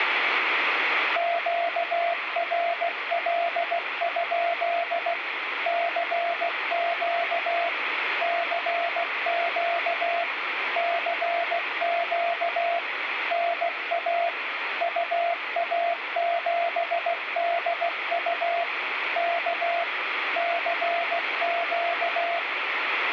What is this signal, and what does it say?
Morse code, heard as a keyed tone, machine-sent, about 16 wpm, 690 Hz, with radio static. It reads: QRL? CQ CQ CQ NA UA7DU K CQ